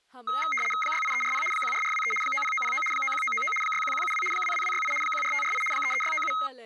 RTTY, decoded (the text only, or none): 68340 14423 90909 91999 61172 22268 14548 33697